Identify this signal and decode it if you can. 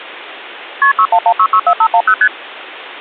Multi-frequency trunk signalling (R1, as on North American trunks), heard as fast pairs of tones, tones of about 70 ms. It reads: KP 611664510 ST